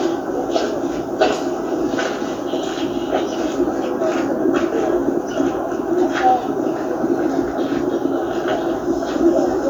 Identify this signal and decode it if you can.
The noise of a park. There is no code.